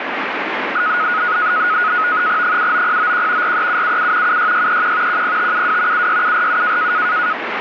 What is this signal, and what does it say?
NAVTEX (SITOR-B), 100 baud, 170 Hz shift, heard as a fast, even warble, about 1360 Hz centre, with radio static. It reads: 79091 43777 76631 10572 76747